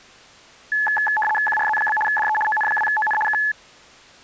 RTTY (75 baud, 850 Hz shift), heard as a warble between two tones, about 1290 Hz centre. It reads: QRZ? DE ON2ON K